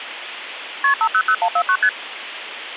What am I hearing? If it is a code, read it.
Multi-frequency trunk signalling (R1, as on North American trunks), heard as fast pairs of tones, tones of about 70 ms, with phone line noise. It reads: KP 500149 ST